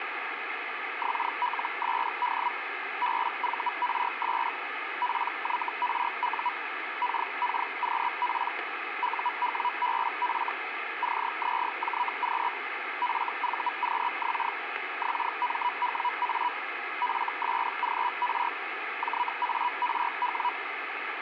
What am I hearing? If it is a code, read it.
Hellschreiber (Feld-Hell, 122.5 baud), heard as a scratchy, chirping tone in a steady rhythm, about 980 Hz, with radio static. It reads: XLSD BVRS PYRU KKQP UWBF CZJQ FVQX XMWA FSGR JARW